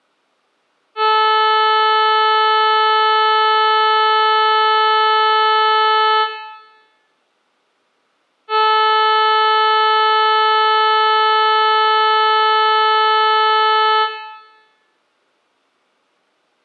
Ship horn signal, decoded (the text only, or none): 2 long